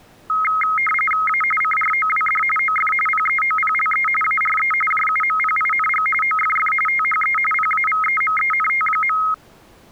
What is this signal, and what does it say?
RTTY (45.45 baud, 850 Hz shift), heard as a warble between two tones, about 1700 Hz centre. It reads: A CROWD OF PEOPLE ARE JUMPING OFF THE PAVEMENT.